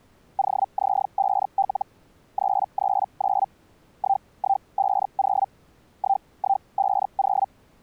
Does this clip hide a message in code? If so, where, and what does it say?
Yes: Hellschreiber (Feld-Hell, 122.5 baud) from 0.4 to 7.5 s, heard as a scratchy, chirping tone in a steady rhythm, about 780 Hz. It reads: OZ5L 339 1150 1150